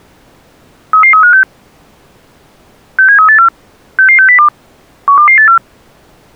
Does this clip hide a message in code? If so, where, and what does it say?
Yes: five-tone selective call (CCIR) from 0.9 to 5.6 s, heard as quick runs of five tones, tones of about 100 ms. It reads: 33356 67384 66602 12284